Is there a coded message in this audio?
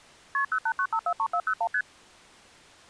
Yes: multi-frequency trunk signalling (R1, as on North American trunks) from 0.3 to 1.8 s, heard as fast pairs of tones, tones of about 70 ms. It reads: KP 089543401 ST